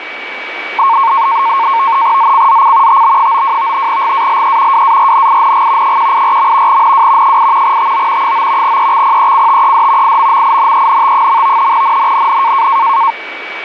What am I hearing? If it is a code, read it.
NAVTEX (SITOR-B), 100 baud, 170 Hz shift, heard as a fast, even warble, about 1000 Hz centre, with radio static and a steady whistle near 2280 Hz. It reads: ZCZC TB92 GALE WARNING 184. NW 8 TO 9 EXPECTED IMMINENT. NNNN